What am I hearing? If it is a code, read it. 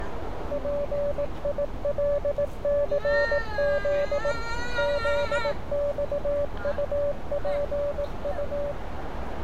Morse code, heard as a keyed tone, machine-sent, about 18 wpm, 580 Hz, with radio static, a narrow filter and street noise. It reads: PILCZ ZXUPU